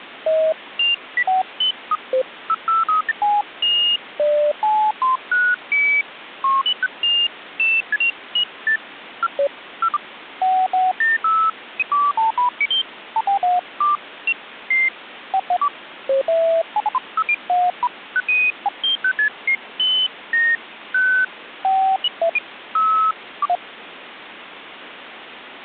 Electronic bleeps of random pitch and length, with phone line noise. There is no code.